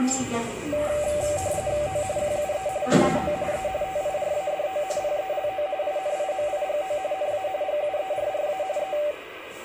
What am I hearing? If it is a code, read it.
RTTY (45.45 baud, 170 Hz shift), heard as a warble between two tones, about 680 Hz centre, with radio static and the noise inside a lift. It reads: O QUE NAO E TIRADO PELO INIMIGO NA GUERRA E